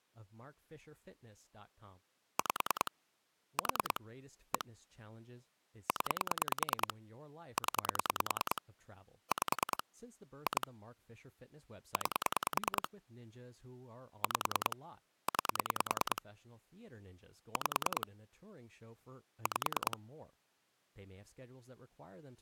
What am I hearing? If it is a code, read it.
Pulse dialling, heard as clicks on a phone line, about 10 pulses a second, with speech in English. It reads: 5 4 1 0 0 5 2 9 5 9 5 5